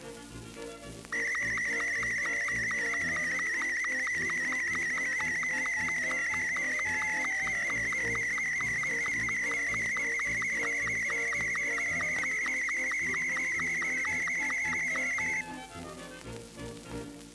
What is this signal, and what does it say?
SSTV (slow-scan television), Martin M2, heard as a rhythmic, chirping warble.